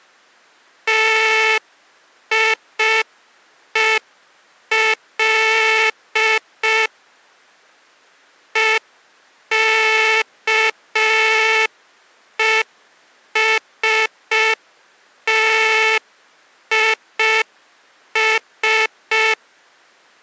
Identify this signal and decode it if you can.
Morse code, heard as a buzzer, machine-sent, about 5 wpm. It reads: TIEL EKESTIS